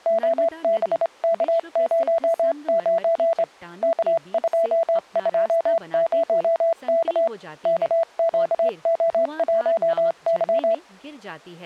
Morse code, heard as a keyed tone, hand-sent with a straight key, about 27 wpm, 660 Hz, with speech in Hindi. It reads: OBK09 K220K KQO1Y